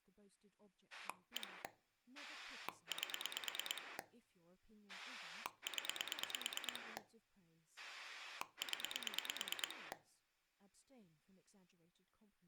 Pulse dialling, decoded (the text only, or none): 1 8 0 0